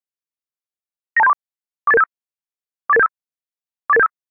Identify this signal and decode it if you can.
Five-tone selective call (EIA), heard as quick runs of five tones, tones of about 30 ms. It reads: 92734 48875 48875 48875